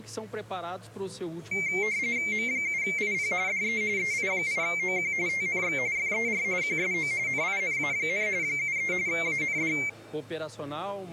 RTTY (45.45 baud, 170 Hz shift), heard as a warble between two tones, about 2200 Hz centre. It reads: M7IP DE EI8OQ TNX FER QSO NINA, 73 AND